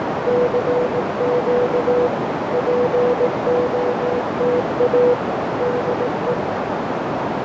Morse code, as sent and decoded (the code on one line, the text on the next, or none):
-.-. --.- / .--. --- - .- / -.. .
CQ POTA DE